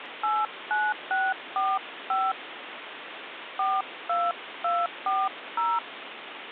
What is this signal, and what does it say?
DTMF, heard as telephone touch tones, dialled by hand, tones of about 220 ms, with phone line noise. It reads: 89645 42240